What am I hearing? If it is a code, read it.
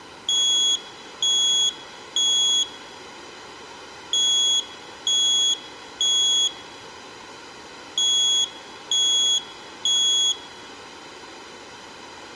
Alarm pattern, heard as an alarm's beeps, played three times, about 3350 Hz, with room echo. Temporal three. Smoke or fire, evacuate.